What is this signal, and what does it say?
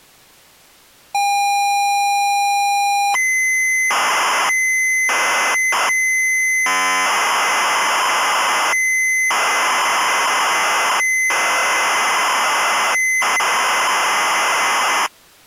ZX Spectrum tape loading, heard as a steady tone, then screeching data.